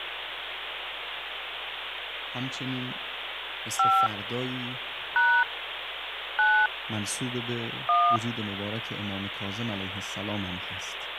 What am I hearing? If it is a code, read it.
DTMF, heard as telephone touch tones, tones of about 270 ms, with phone line noise. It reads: 5 # 9 1